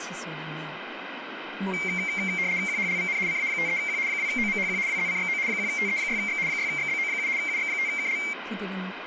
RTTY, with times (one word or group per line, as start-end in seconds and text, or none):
2.7-3.2 QHLVN
3.3-4.0 CA53Q
4.1-4.8 2OMHQ
4.9-5.4 WZCXO
5.5-6.4 1TE6X
6.5-7.3 6XBO7
7.4-8.2 UX5KL